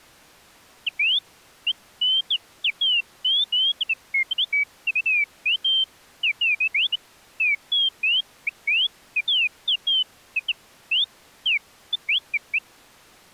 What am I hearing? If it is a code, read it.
Bird-like chirps. There is no code.